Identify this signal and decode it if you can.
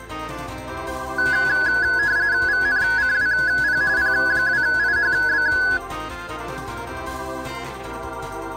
RTTY (45.45 baud, 170 Hz shift), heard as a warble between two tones, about 1600 Hz centre. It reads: VNCWP P2IHB